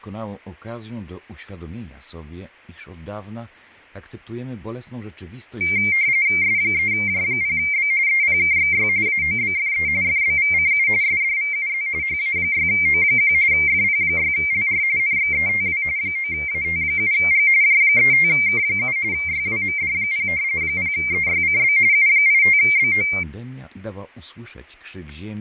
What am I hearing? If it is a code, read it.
RTTY (45.45 baud, 170 Hz shift), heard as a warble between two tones, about 2200 Hz centre, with fading, static crashes and speech in Polish. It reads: S3J0B EPKXY AOBFE FBVCU SDVUZ HA6O1 FP6LR NXETW 9AT7G J35K7 YWMD0 0EYCB U85BO